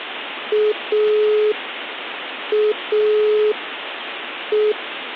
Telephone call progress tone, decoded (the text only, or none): dial tone